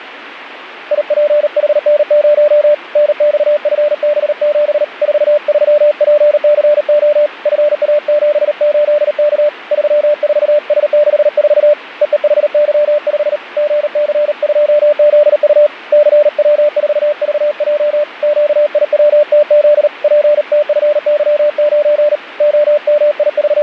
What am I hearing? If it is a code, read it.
Morse code, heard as a keyed tone, hand-sent with a paddle, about 38 wpm, 590 Hz. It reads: IPHN0 NXFB7 43PCO FA78K 34S64 EEHY5 GC2ZU CW4VJ QIWTZ PTFY9 …